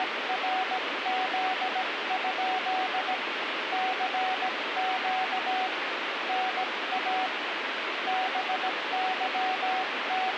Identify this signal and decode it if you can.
Morse code, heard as a keyed tone, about 17 wpm, 750 Hz, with radio static. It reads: … CQ NA …